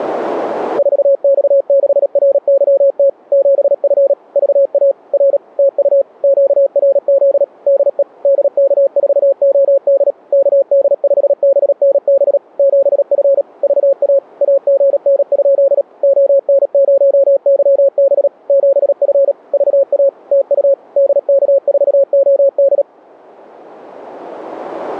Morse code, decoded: 4X6RYT 7F VA R TU QRZ DE DK4OD KD5BNB 7F VA AGN? ON0YB 7F VA TU DK4OD

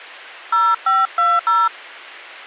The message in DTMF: 0520

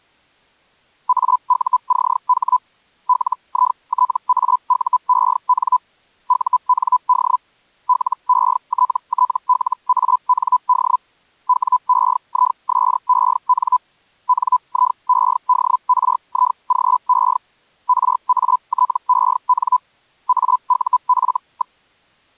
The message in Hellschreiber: AUCH LITAUEN UND LETTLAND WEISEN NIEDRIGE RATEN AUF.

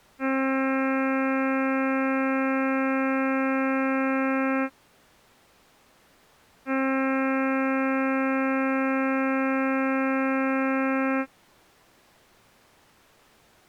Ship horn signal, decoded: 2 long

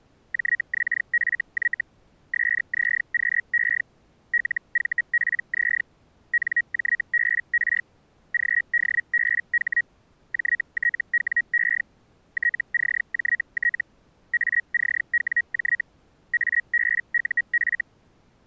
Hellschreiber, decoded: JXFY SZQE LVPZ NJBR GDBH JTWE TCJT ACWJ ABUF

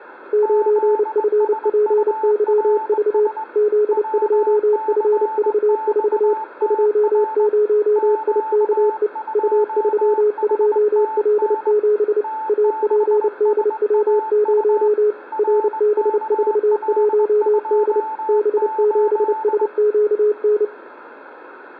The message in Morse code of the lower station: 9FPYV Z2FV4 20IKE U32L7 APDW0 RB41D B7SQN

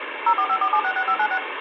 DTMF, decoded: 0454766596

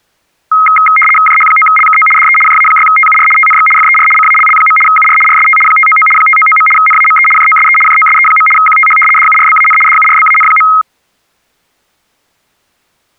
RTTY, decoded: JH9LKO DE JA6TUR TNX FER CALL. UR RST 599 599. NAME JOSE JOSE. QTH DURBAN DURBAN.

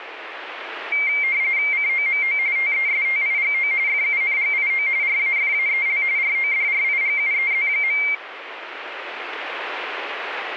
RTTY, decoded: COMO TESTIGO FUNGIO RAFAEL RODRIGUEZ.

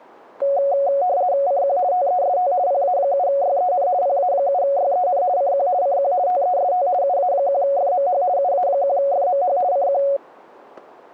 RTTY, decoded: CQ TEST PA7YEN PA7YEN CQ CQ TEST UA1FMH UA1FMH CQ

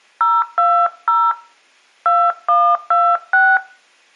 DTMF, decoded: 020 2126

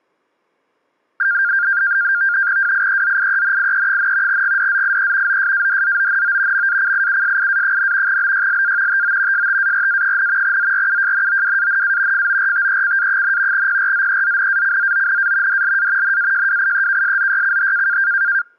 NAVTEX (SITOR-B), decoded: WIEZIENIE, GDZIE OSADZONO MACIUSIA, BYLA TO STARA, ZRUJNOWANA FORTECA, PRZEZNACZONA DLA NAJWIEKSZYCH

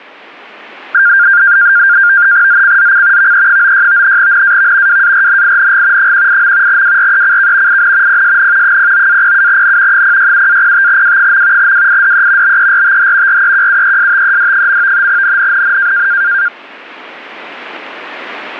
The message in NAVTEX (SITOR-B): ZCZC VE96 NAV WARNING 18. WRECK IN PSN 09-07N 067-05W. WIDE BERTH REQUESTED. NNNN

